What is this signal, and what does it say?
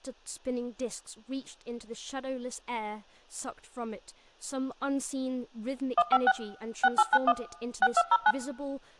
DTMF, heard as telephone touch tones, dialled by machine, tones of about 50 ms, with speech in English. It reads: 156 6891 6209